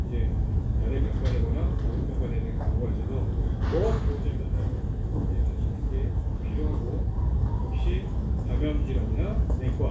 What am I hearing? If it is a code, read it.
The noise of a crowd indoors. There is no code.